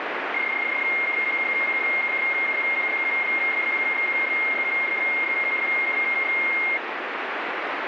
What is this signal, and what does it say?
PSK31 (31.25 baud), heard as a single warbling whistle, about 2150 Hz, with radio static.